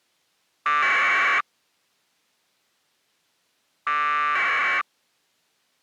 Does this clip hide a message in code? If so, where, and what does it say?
Yes: packet radio (AX.25, as in APRS), 1200 baud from 0.7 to 4.8 s, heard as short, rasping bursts.